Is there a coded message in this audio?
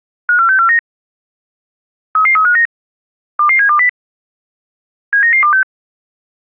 Yes: five-tone selective call (CCIR) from 0.3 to 5.6 s, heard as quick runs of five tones, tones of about 100 ms. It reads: 54649 33359 22720 79926